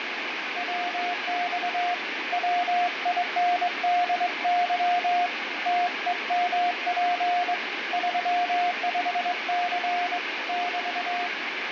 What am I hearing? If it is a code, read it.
Morse code, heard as a keyed tone, hand-sent with a straight key, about 22 wpm, 710 Hz, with heavy radio static and fading. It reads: WX WINDY TEMP 35C <BT>